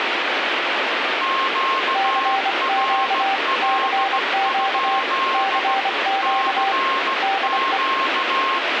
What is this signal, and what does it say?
Morse code, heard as two keyed tones, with radio static. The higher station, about 16 wpm, 1070 Hz: QRL? CQ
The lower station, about 25 wpm, 780 Hz: CQ CQ CQ DE